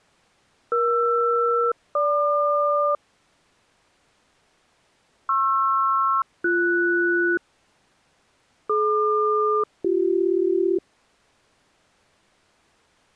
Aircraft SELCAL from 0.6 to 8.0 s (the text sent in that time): ER-GQ PR-BS